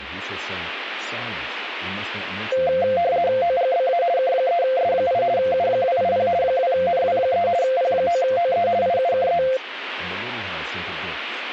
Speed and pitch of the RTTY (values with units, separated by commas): 50 baud, 170 Hz shift, 610 Hz centre